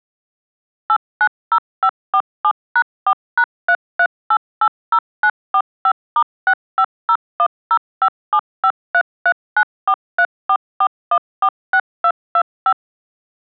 DTMF, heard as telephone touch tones, dialled by machine, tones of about 70 ms. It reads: 890547#4#33880945*650105753394344146225